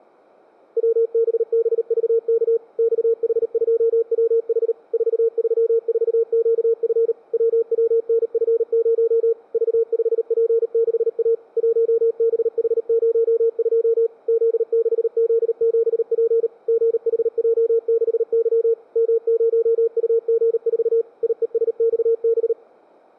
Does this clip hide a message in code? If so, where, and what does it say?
Yes: Morse code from 0.7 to 22.6 s, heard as a keyed tone, machine-sent, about 38 wpm, 460 Hz. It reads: WBBVK XH2WH 434QF WWNF0 V5P6A 1BH02 Z6Z7P GHJ6Y M0UG4 IESXB